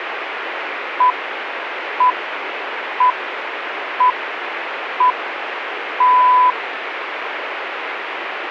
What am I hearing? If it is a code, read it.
Radio time signal (six pips, as the Greenwich Time Signal), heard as pips, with radio static.